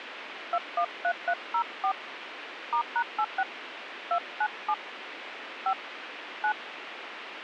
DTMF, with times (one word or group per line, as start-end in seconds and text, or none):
0.5-1.9 213304
2.7-3.4 *#86
4.1-4.7 297
5.7-5.7 5
6.4-6.5 9